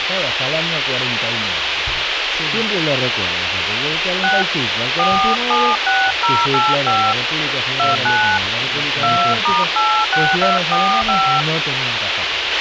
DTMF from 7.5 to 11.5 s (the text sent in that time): 29 2*86245